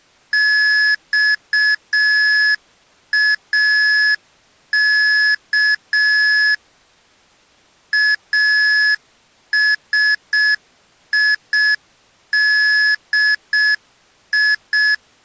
Morse code (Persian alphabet), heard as electronic beeps, machine-sent, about 6 wpm, 1700 Hz. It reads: خاک اسیدی